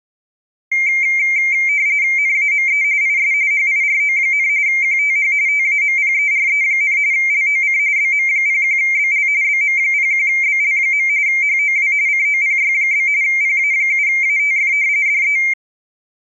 RTTY (45.45 baud, 170 Hz shift), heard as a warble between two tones, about 2200 Hz centre. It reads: NAME IS HIRO, QTH TAMPERE, LOC BM01BL BM01BL. HOW COPY? PA7ATF DE